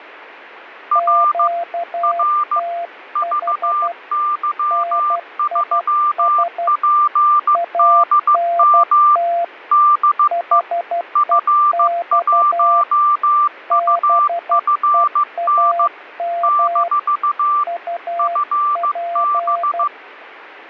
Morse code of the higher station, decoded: R R VY3PDM DE F1UFN - FB

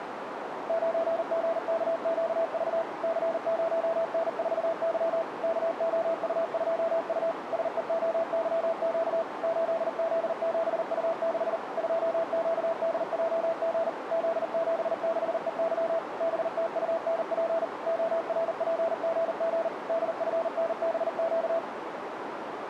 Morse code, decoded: 9GKQV C0N4Y KOU2U SEOYQ 8Z7U6 2QDJG Z76EY BTUNP ORPGG DFNBQ

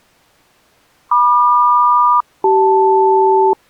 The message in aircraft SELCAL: MQ-CL

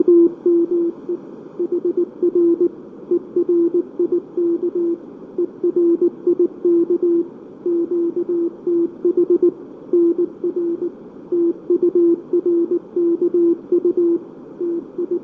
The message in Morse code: … HR ERIK ERIK QTH NR TURKU …

